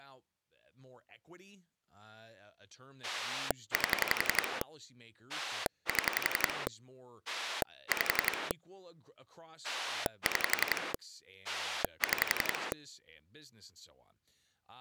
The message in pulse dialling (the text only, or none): 8 7 5 6 6